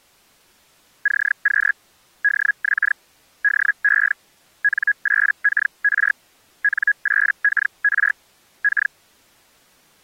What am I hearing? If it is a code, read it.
Hellschreiber (Feld-Hell, 122.5 baud), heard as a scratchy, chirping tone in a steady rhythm, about 1650 Hz. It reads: CQ DX DE N8KR N8KR K